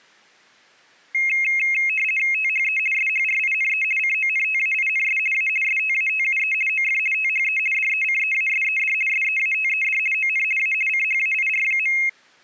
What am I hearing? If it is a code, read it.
RTTY (50 baud, 450 Hz shift), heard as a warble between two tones, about 2350 Hz centre. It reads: THE SHRINE CONTAINS A STATUE OF THE DECEASED SEATED ON A CHAIR.